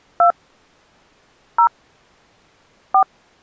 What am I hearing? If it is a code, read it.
DTMF, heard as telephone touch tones, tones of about 80 ms. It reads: 2 0 4